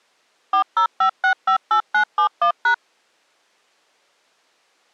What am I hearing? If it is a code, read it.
DTMF, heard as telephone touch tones, dialled by machine, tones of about 90 ms. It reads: 405658971#